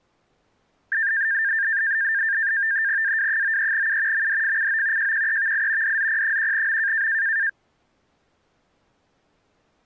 NAVTEX (SITOR-B), 100 baud, 170 Hz shift, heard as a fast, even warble, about 1700 Hz centre. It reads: AW93U MDFCO JQEVI DZP1M